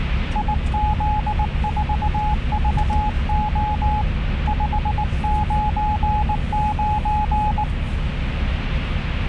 Morse code, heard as a keyed tone, hand-sent with a paddle, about 19 wpm, 840 Hz, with radio static and the noise inside a car. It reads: IZ4VO 599